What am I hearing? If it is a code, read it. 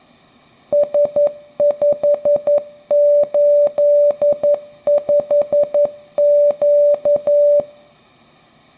Morse code, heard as a keyed tone, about 11 wpm, 580 Hz. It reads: S585Q